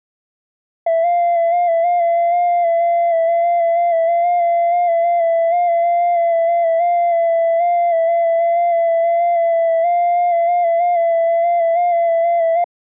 FT8 (one signal), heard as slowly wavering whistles, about 6.25 baud.